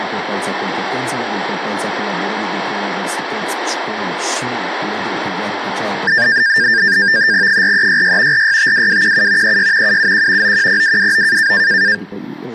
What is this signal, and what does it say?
NAVTEX (SITOR-B), 100 baud, 170 Hz shift, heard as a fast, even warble, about 1700 Hz centre. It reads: 4366 4652217 36 771 910229